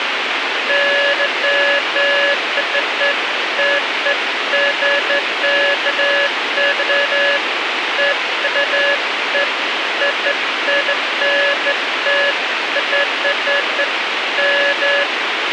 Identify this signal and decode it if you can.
Beeps of irregular length, with radio hiss and a squelch burst at the end. There is no code.